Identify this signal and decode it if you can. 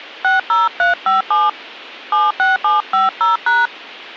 DTMF, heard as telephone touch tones, dialled by hand, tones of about 160 ms. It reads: 60357 76750#